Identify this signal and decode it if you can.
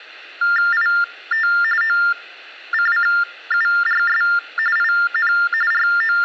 TTY/TDD text telephone tones (45.45 baud Baudot), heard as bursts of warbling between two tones, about 400 Hz shift, 1600 Hz centre. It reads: IT OCCURS IN …